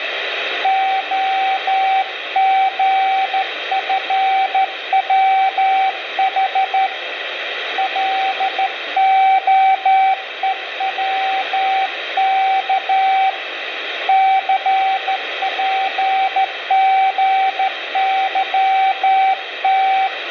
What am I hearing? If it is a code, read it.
Morse code, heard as a keyed tone, hand-sent with a straight key, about 13 wpm, 770 Hz, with radio static and room echo. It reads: OGFWH LOEWK CPGYT